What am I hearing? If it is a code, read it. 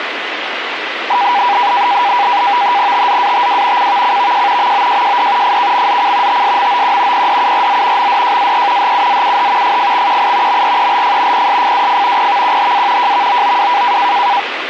NAVTEX (SITOR-B), 100 baud, 170 Hz shift, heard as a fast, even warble, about 890 Hz centre, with radio static. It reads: TZATW CVCVJ MOJJD FKMZC TSMOQ PDURZ MDJAE HUZUH FFXQI MRELF PSFWF PVQHA JVOOW